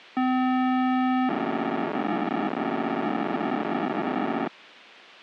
POCSAG pager data (512 baud), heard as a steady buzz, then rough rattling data.